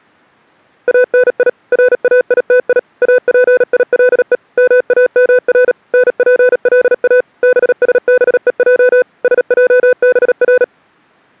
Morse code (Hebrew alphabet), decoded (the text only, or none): אני ראיתי אפילו מאמר נפלא בשבוע שעבר